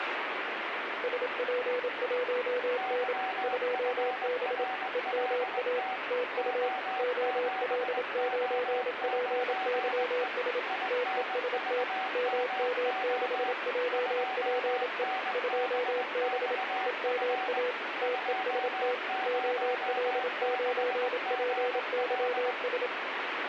Morse code, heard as two keyed tones, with radio static. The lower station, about 27 wpm, 500 Hz: SP1N 2B EMA TU OL9PYS TEST MM6JPE 2B EMA TEST OL9PYS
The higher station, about 20 wpm, 760 Hz: YFRLT O7O9E INVMO 2NBXF 206GL